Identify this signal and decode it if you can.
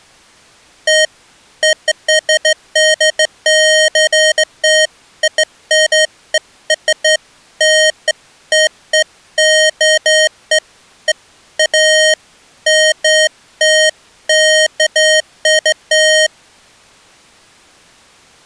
Beeps of irregular length. There is no code.